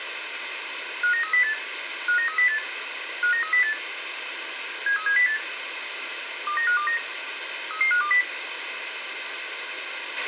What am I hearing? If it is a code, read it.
Five-tone selective call (CCIR), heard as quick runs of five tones, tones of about 100 ms, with radio hiss and a squelch burst at the end. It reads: 59308 59308 59308 73708 29529 33520